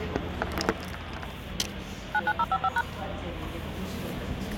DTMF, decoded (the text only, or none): 99055#